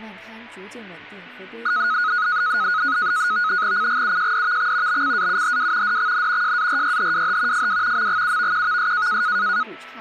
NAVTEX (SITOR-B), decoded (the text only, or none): CGUJDVX BCAUHW DXN JARYHWH FW MGUVQVS